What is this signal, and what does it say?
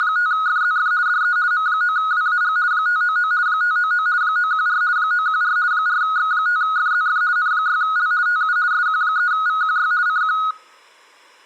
RTTY (50 baud, 170 Hz shift), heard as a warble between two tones, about 1360 Hz centre, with room echo. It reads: … DE M9WAG 599 599 914 914 4X5FZF N6L TU SQ3VQY CQ